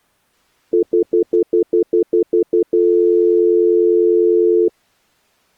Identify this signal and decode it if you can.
Telephone call progress tone (North American plan), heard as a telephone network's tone, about 350, 440 Hz, 0.1 s on and 0.1 s off. Stutter dial tone.